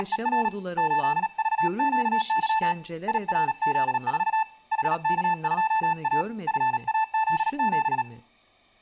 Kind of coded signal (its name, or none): Morse code